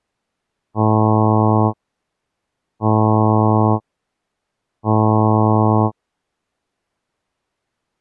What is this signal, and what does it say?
Ship horn signal, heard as a ship's horn, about 110 Hz. 3 short. At sea: I am operating astern propulsion.